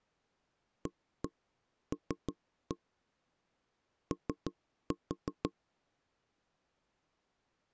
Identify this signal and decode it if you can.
Tap code, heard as knocks on wood, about 6 knocks a second. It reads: AL O